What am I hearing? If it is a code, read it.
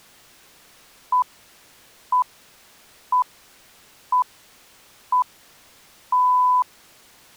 Radio time signal (six pips, as the Greenwich Time Signal), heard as pips.